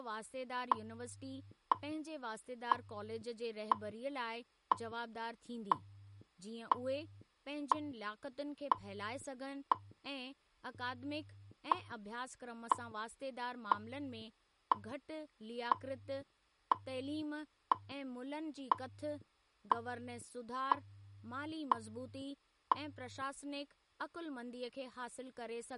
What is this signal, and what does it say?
Radio time signal (WWV, Colorado), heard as ticks, one a second, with speech in Sindhi.